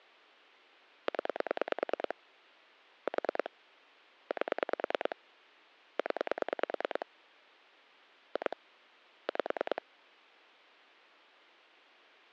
Pulse dialling, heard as clicks on a phone line, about 9 pulses a second. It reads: 0 4 8 0 2 5